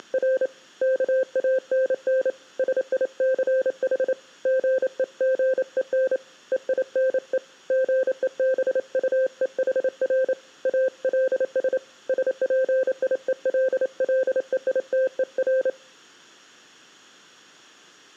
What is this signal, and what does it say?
Morse code, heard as a keyed tone, hand-sent with a paddle, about 28 wpm, 520 Hz. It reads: … KANN SICH GEGEN EINE GEBUEHR ALS SPIELLEITER